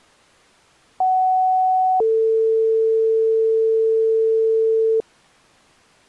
Two-tone page, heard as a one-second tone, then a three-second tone, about 750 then 450 Hz.